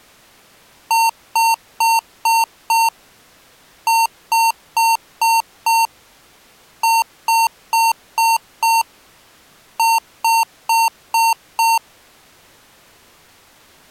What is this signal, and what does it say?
Beep code, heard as beeps from a small speaker, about 910 Hz. 5-5-5-5.